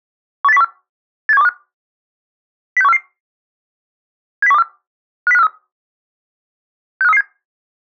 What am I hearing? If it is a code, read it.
Five-tone selective call (EEA), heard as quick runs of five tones, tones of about 40 ms. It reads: 18014 87125 06144 70124 50543 65337